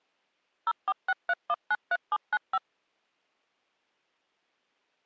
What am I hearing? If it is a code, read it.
DTMF, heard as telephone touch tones, dialled by machine, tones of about 40 ms. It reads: 0463193795